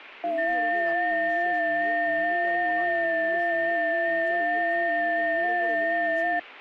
FT8 (several signals at once), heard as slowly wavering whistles, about 6.25 baud, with speech in Bangla.